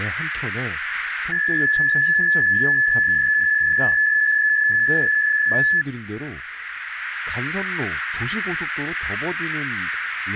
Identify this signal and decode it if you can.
PSK63 (62.5 baud), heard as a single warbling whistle, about 1700 Hz, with radio static and speech in Korean.